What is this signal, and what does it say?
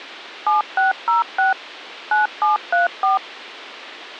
DTMF, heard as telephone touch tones, dialled by machine, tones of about 140 ms. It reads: 7606 9734